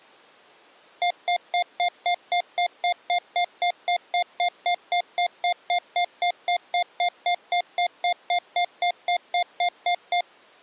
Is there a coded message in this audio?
No, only evenly repeated beeps.